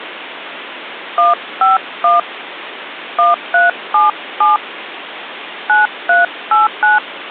DTMF, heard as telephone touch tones, dialled by hand, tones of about 160 ms, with phone line noise. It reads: 151 1377 9389